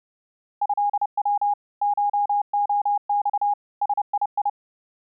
Morse code (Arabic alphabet), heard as a keyed tone, machine-sent, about 30 wpm, 820 Hz. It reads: هو شخص سيي